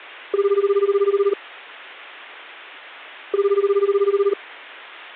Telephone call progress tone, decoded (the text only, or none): ringback tone